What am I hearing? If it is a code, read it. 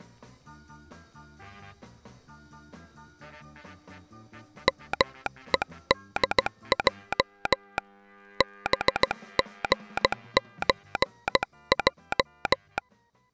Morse code (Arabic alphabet), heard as a telegraph sounder, hand-sent with a paddle, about 16 wpm. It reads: مءدج بغزج